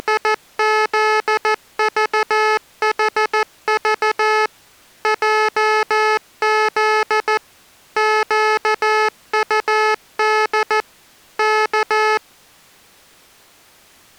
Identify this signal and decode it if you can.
Morse code, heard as electronic beeps, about 14 wpm, 430 Hz. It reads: … JZ QUD K